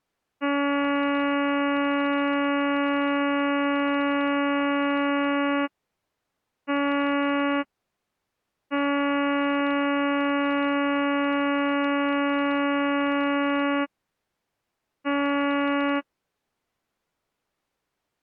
Ship horn signal, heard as a ship's horn, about 280 Hz. 1 long, 1 short, 1 long, 1 short. At sea: I agree to be overtaken.